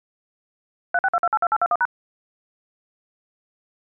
DTMF, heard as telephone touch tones, dialled by machine, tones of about 50 ms. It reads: 362282821#